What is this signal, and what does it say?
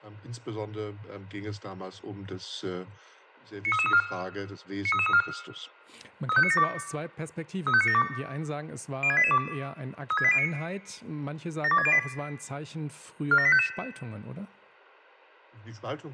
Five-tone selective call (ZVEI), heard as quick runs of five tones, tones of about 70 ms, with room echo. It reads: 93334 93334 35972 35972 06882 36809 72608 47855